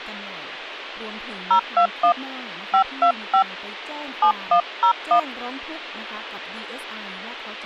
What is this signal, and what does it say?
DTMF, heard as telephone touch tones, dialled by hand, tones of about 90 ms, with speech in Thai. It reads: 021 525 7101